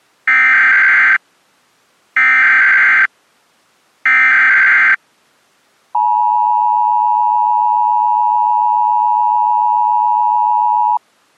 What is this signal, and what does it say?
Emergency Alert System (SAME) tones (header bursts, then the 853 and 960 Hz attention tone), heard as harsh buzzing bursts, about 520.83 baud.